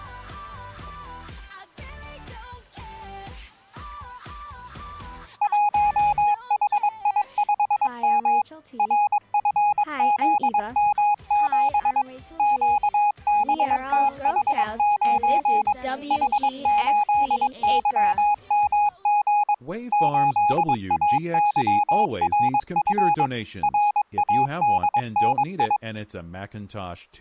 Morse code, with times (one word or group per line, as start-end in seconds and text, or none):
5.4-8.4 1HI5M
8.8-12.0 RFZM7
12.4-15.7 QBTH9
16.1-19.5 H8YMG
19.9-23.3 8AYRF
23.6-25.8 RADNI